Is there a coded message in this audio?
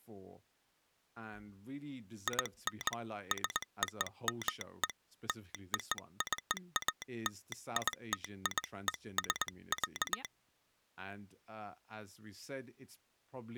Yes: Morse code (American railroad code) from 2.2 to 10.3 s, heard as a telegraph sounder, hand-sent with a straight key, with speech in English. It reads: IN SOME LOCALITIES,